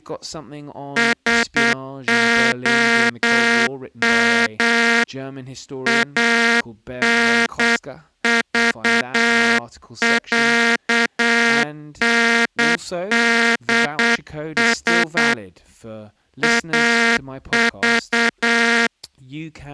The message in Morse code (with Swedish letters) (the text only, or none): SOM ANVÄNDS AV